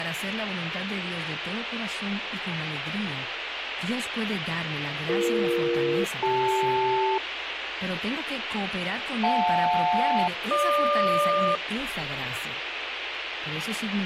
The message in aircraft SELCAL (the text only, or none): BE-CL JL-GQ